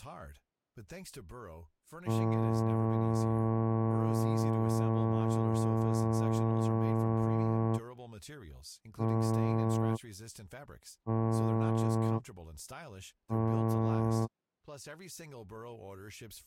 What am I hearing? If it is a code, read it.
Ship horn signal, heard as a ship's horn, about 110 Hz, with speech in French. 1 long, 3 short. At sea: a vessel under tow in fog.